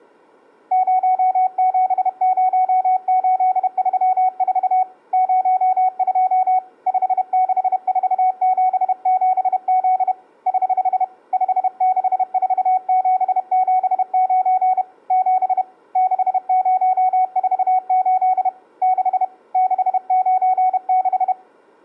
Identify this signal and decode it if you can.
Morse code, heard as a keyed tone, hand-sent with a paddle, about 31 wpm, 740 Hz. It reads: 070834 02 56477Z <HH> 564779 7 6048 6 696